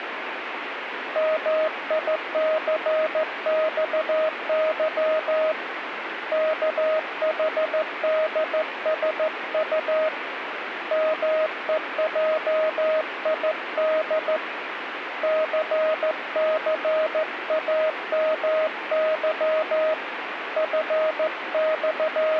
Morse code, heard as a keyed tone, hand-sent with a straight key, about 14 wpm, 630 Hz, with radio static. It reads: MICXY KHDSU MEJID CCAMY …